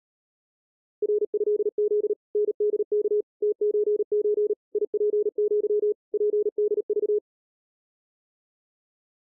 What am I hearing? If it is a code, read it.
Morse code (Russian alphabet), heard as a keyed tone, machine-sent, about 38 wpm, 420 Hz. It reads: РЭЗ НДК ТЧЧ ИПЪ ПДЖ